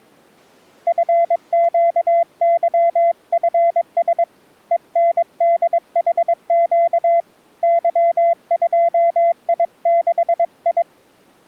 Morse code, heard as a keyed tone, hand-sent with a paddle, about 22 wpm, 680 Hz. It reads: FQYFS ENDHQ Y2I6I